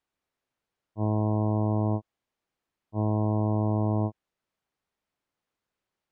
Ship horn signal, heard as a ship's horn, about 110 Hz. 2 short. At sea: I am altering course to port.